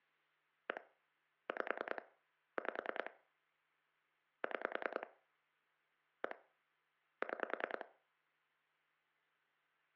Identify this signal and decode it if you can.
Pulse dialling, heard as clicks on a phone line, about 10 pulses a second, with hum and room echo. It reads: 1 5 5 6 1 6